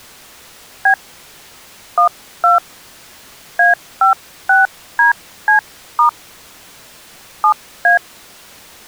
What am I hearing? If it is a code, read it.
DTMF, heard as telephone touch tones, dialled by hand, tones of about 120 ms. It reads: B 12 A56DC* 7A